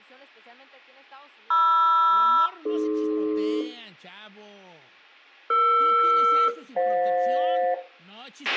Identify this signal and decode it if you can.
Aircraft SELCAL, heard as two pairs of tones, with a squelch burst at the end, room echo and speech in Spanish. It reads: MR-AD ER-FJ